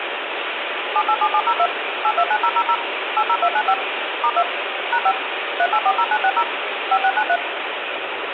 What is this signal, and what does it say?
DTMF, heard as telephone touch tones, dialled by machine, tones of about 60 ms, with phone line noise and room echo. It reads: 787702 829000 80295 *2 #5 3840960 5693